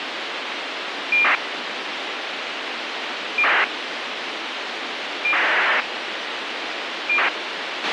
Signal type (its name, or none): ACARS aircraft data